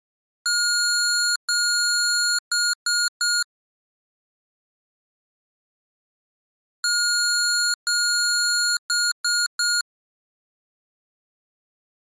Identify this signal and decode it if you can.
Beep code, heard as beeps from a small speaker, played twice, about 1430 Hz. 2 long, 3 short.